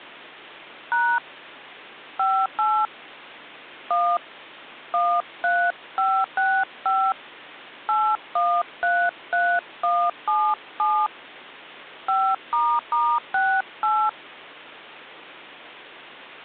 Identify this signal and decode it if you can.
DTMF, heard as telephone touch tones, dialled by hand, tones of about 260 ms, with hum. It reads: # 58 1 13565 8133177 5**68